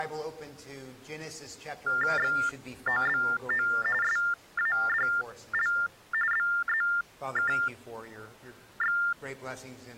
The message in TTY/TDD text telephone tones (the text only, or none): XOBO SADL BZKX